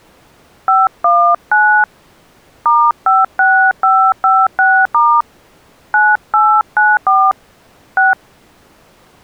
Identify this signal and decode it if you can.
DTMF, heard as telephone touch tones, dialled by hand, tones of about 230 ms. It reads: 519 *56556* 9894 6